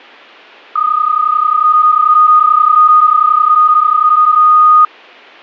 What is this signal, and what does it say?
PSK31 (31.25 baud), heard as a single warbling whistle, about 1240 Hz.